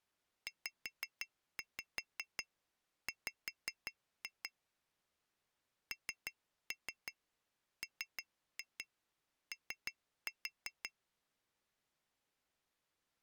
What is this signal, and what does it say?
Tap code, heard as taps on glass, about 5 knocks a second. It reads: ZW NMO